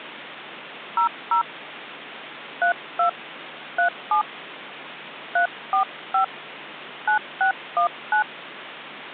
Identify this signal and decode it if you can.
DTMF, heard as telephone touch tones, dialled by hand, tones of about 100 ms, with phone line noise. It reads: 00 32 37 345 9619